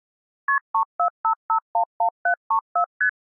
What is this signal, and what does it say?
Multi-frequency trunk signalling (R1, as on North American trunks), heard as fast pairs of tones, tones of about 90 ms. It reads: KP 345511734 ST